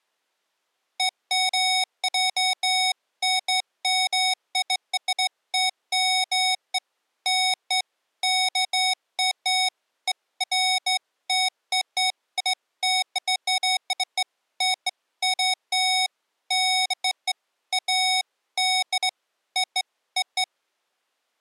Beeps of irregular length. There is no code.